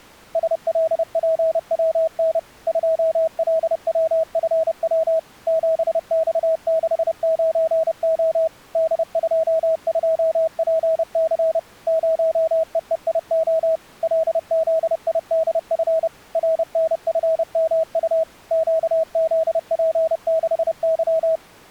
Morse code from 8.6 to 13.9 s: D22PC 0EEIO

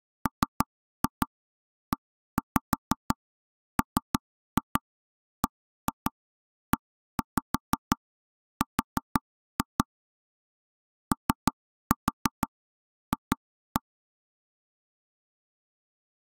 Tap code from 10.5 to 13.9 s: OF

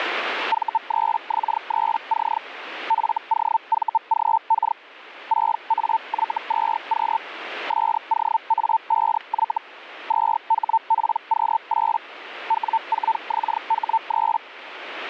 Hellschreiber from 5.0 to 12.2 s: 6AY2Q SOA5Y 2HPQ8

